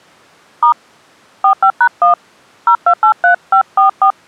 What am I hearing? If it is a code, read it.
DTMF, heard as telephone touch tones, dialled by hand, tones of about 100 ms. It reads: * 45#1 0283544